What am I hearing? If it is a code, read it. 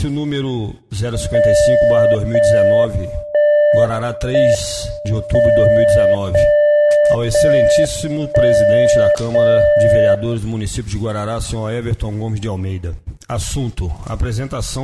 Radio time signal (JJY), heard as a tone whose level steps once a second, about 590 Hz. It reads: 0 1 1 M 0 0 1 0 0